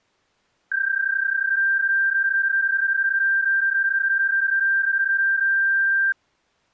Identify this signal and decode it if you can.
PSK31 (31.25 baud), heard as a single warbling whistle, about 1600 Hz.